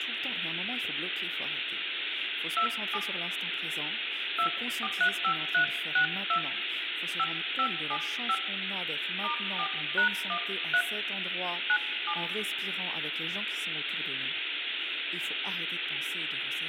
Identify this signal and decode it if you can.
DTMF, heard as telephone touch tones, dialled by hand, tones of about 70 ms, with phone line noise and speech in French. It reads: 27 2435362 5575 *4#13 97